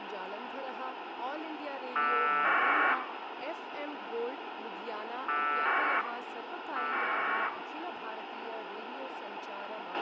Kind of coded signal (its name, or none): packet radio (AX.25, as in APRS)